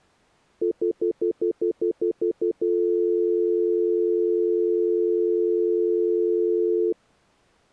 Telephone call progress tone (North American plan), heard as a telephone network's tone, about 350, 440 Hz, 0.1 s on and 0.1 s off. Stutter dial tone.